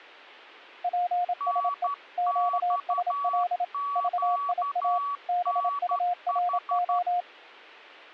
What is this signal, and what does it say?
Morse code, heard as two keyed tones. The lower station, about 27 wpm, 710 Hz: PSE QSL VIA BURO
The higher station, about 12 wpm, 1140 Hz: NXQNH